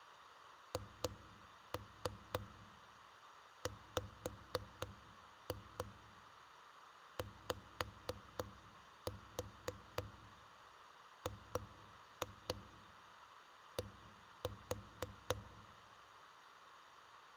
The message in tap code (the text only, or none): HWYGD